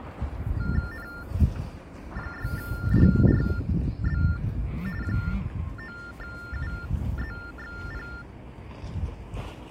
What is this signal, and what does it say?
TTY/TDD text telephone tones (45.45 baud Baudot), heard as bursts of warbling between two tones, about 400 Hz shift, 1600 Hz centre, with the noise of a residential street. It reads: N6DRB 9UZXP